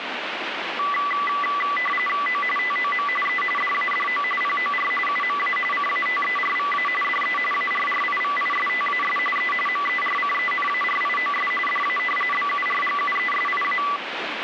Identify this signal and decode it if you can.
RTTY (45.45 baud, 850 Hz shift), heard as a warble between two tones, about 1550 Hz centre, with radio static. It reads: O TOM E DADO POR UMA CATERVA DE ARRIVISTAS E MERCENARIOS DA BURGUESIA